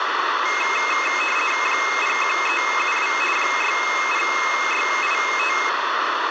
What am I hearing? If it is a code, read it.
RTTY (50 baud, 450 Hz shift), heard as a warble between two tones, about 2350 Hz centre, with radio static and room echo. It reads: 01372 60685